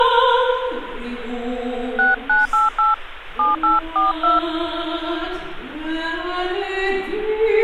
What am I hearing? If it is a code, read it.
DTMF, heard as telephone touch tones, dialled by hand, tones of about 160 ms, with phone line noise. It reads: 6988 7842